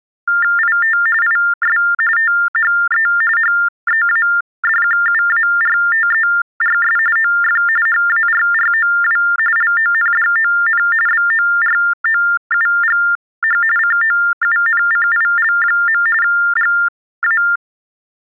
TTY/TDD text telephone tones (45.45 baud Baudot), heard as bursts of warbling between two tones, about 400 Hz shift, 1600 Hz centre. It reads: IT IS THE HEADQUARTERS OF HARROW LONDON BOROUGH COUNCIL. GA